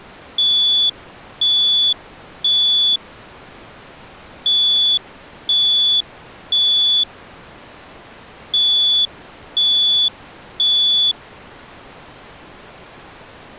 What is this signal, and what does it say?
Alarm pattern, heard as an alarm's beeps, played three times, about 3450 Hz. Temporal three. Smoke or fire, evacuate.